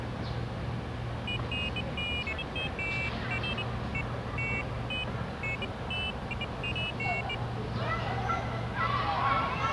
Pairs of high tones at irregular times, with radio hiss, a squelch burst at the end and the noise of a residential street. There is no code.